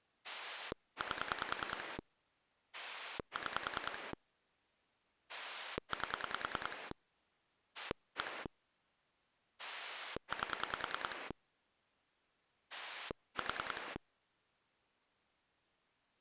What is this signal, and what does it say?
Pulse dialling, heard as a rotary dial, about 10 pulses a second. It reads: 8 6 8 1 8 4